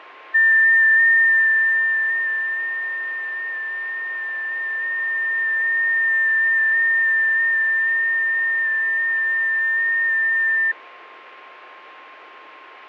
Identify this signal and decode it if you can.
FT8 (one signal), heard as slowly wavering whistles, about 6.25 baud, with radio static, fading and a steady whistle near 1060 Hz.